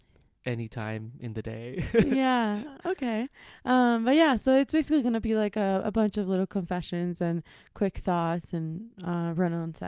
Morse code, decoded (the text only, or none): none